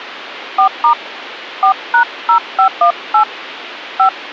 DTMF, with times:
0.6-0.9 4*
1.6-3.2 4#0518
4.0-4.1 5

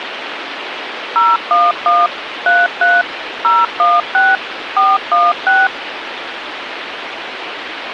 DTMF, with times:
1.2-2.1 011
2.5-3.0 33
3.4-4.4 016
4.8-5.7 416

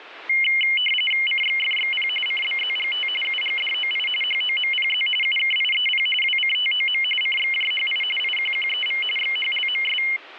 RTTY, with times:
1.3-2.1 CXFXP
2.3-3.1 CBZGT
3.2-4.1 UGDOI
4.2-5.1 HOMPZ
5.2-6.1 UKIEP
6.2-7.0 WCTOM
7.2-8.0 CXJHI
8.2-9.0 IQQEV
9.2-10.0 XHLMS

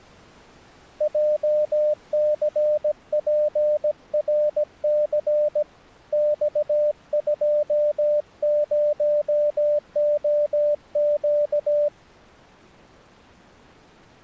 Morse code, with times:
1.0-5.6 JCPRC
6.1-11.9 X20OQ

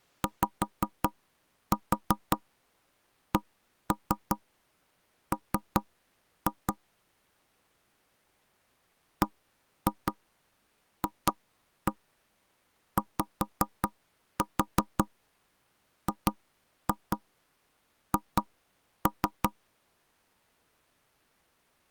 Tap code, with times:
0.2-6.7 YCM
9.2-19.5 BFYGH

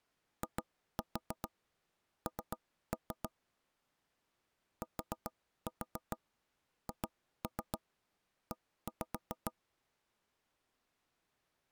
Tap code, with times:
0.4-3.3 IN
4.8-9.5 THE

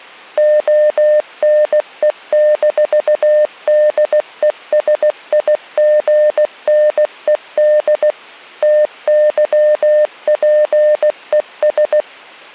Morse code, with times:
0.4-8.1 ONE-DESIGNED
8.6-12.0 TYPES

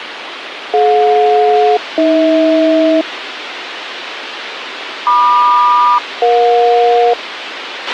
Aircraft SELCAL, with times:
0.7-3.0 DJ-AH
5.1-7.1 MQ-EJ

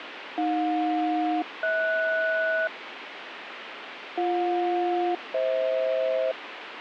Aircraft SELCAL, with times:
0.4-2.7 AJ-HS
4.2-6.3 BJ-FH

